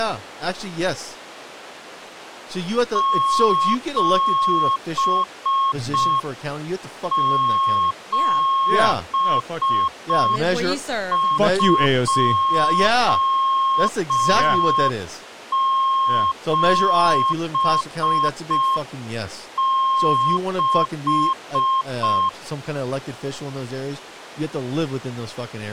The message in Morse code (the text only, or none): 77276